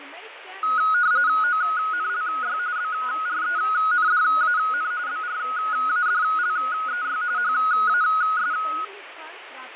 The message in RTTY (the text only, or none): ONLY BRENDAN BRADLEY HAS